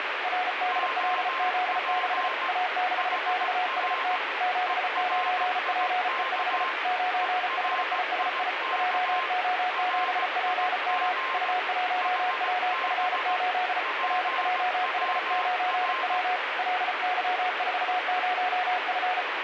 Morse code, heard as two keyed tones, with radio static. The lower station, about 34 wpm, 730 Hz: RDLZ6 A6XST 79PE5 9HISI JO7PM U1WF8 RJH9W LY40F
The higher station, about 17 wpm, 1050 Hz: OP HR ERIK ERIK RIG HB PWR